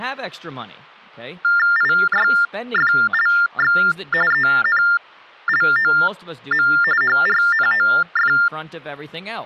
TTY/TDD text telephone tones (45.45 baud Baudot), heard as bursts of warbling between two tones, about 400 Hz shift, 1600 Hz centre, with speech in English. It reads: IYFLX ENLOM HRNOF